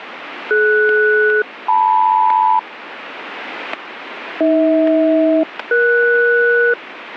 Aircraft SELCAL, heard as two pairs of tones, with radio static and static crashes. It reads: DS-LM AH-ES